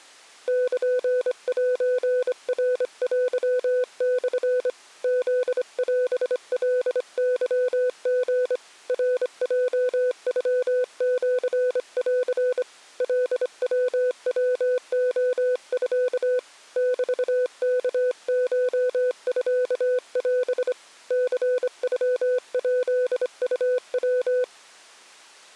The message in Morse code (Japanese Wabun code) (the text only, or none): ルセナテモ フオカケリ ナヲノシン カヤヤレミ メワコミオ ニノヱウヤ